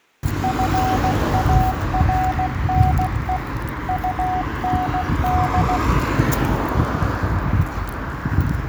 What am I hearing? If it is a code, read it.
Morse code, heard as a keyed tone, machine-sent, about 16 wpm, 740 Hz, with room echo and street noise. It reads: FARNE UND